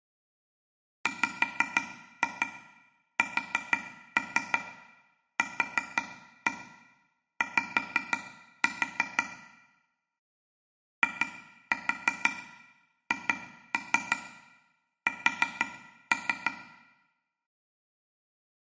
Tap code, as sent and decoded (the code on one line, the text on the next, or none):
5-2 4-3 4-1 5-4 / 2-4 2-3 4-3
WSQY IHS